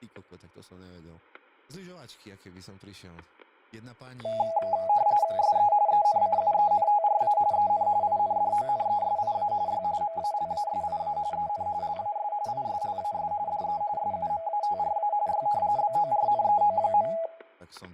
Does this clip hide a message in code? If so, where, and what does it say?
Yes: RTTY (45.45 baud, 170 Hz shift) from 4.2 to 17.3 s, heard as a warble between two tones, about 740 Hz centre, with fading, static crashes and speech in Slovak. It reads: SE ENCUENTRA EN INDONESIA Y MALASIA EN LAS ISLAS DE SUMATRA Y BORNEO.